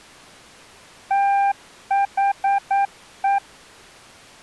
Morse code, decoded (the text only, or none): THE